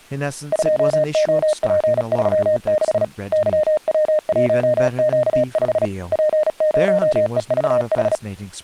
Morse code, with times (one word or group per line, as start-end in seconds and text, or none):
0.5-3.0 2OP36
3.3-5.9 YW1Q5
6.1-8.2 P0EVH